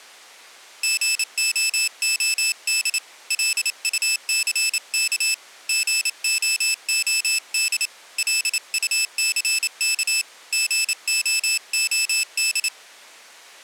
Morse code, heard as a high beeper, hand-sent with a paddle, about 28 wpm, 2600 Hz. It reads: GOOD LUCK GOOD LUCK GOOD